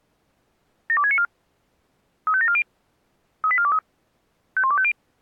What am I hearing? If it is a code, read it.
Five-tone selective call (ZVEI), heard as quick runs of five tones, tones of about 70 ms. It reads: 72694 35740 38423 51250